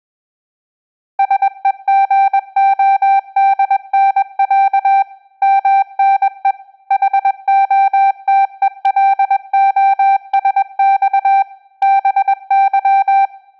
Morse code (Russian alphabet), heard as a keyed tone, machine-sent, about 21 wpm, 780 Hz. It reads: СЕГОДНЯ МНЕ ХОТЕЛОСЬ БЫ